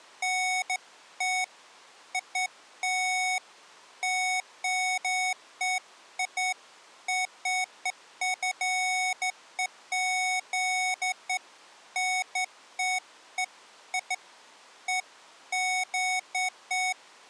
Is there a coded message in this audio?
No, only beeps of irregular length.